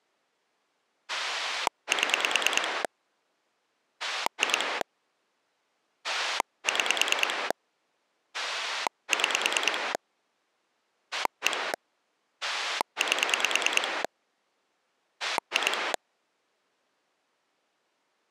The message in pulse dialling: 7 2 6 6 1 8 2

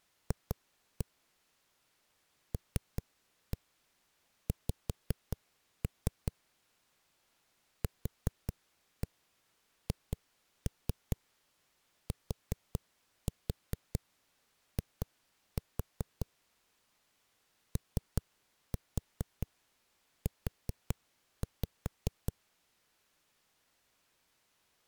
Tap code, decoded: F LX QHTI OU

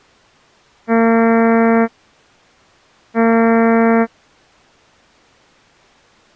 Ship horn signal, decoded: 2 short

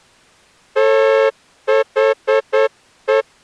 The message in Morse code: THE

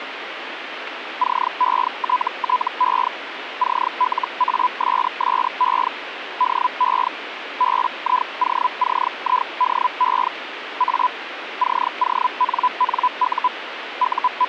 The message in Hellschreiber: CETTE CLASSE DE BIOCIDE A CONNU …

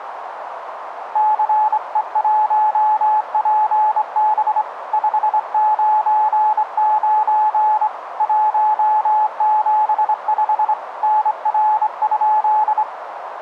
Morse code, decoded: CE1PB 599 175 NR?

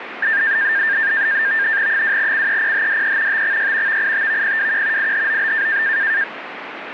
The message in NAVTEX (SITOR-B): 2CEPHDE TXY VITVPWQ IHOB

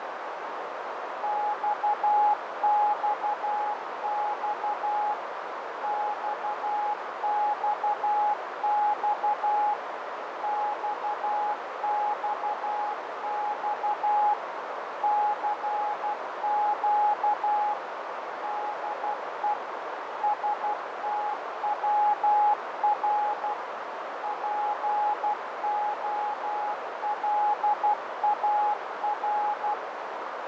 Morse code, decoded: XXX XXX XXX CQ DE STWR POLAR

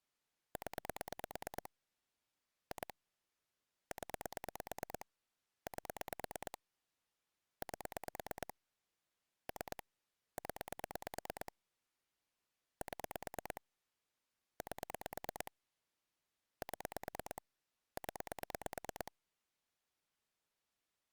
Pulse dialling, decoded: 0 2 0 8 8 3 0 7 8 7 0

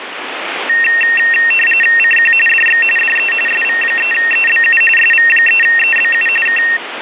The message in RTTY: CQ DX DE SV3EBU SV3EBU K

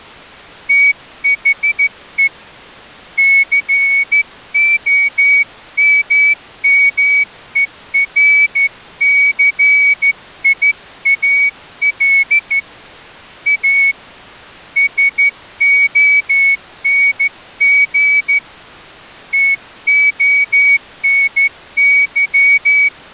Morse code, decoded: THE COMMERCIAL A SONG TONY

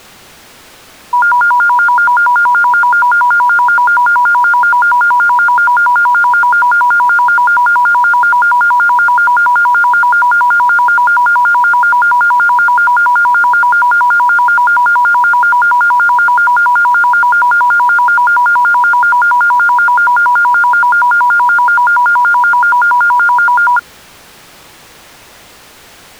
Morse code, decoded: none

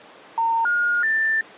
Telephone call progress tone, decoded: special information tone

